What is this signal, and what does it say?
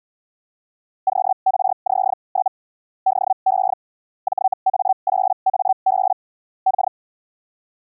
Hellschreiber (Feld-Hell, 122.5 baud), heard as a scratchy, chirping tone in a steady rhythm, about 760 Hz. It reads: QRZ? DE JA8AB K